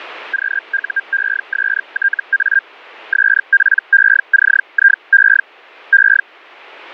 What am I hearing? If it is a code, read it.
Hellschreiber (Feld-Hell, 122.5 baud), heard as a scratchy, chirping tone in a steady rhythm, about 1600 Hz. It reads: QUESTA SPECIE E